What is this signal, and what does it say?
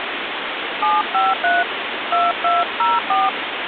DTMF, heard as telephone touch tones, dialled by hand, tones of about 190 ms, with phone line noise. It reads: 753 2204